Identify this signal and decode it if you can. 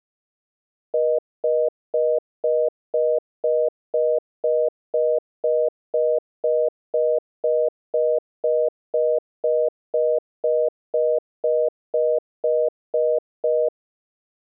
Telephone call progress tone (North American plan), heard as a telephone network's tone, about 480, 620 Hz, 0.25 s on and 0.25 s off. Congestion tone.